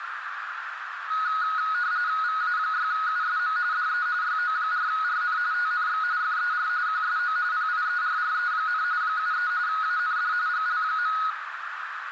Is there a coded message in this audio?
Yes: RTTY (45.45 baud, 170 Hz shift) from 1.1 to 11.3 s, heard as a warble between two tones, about 1360 Hz centre, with radio static and a narrow filter. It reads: VA6USM DE YO4RN TNX FER QSO PIERRE, 73 AND GL.